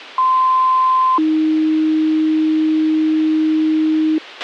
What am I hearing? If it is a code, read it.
Two-tone page, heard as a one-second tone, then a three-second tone, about 1040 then 310 Hz, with a squelch burst at the end.